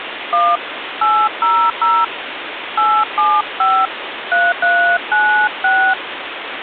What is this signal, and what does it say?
DTMF, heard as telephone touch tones, dialled by hand, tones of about 270 ms, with phone line noise. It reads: 1 800 875 3396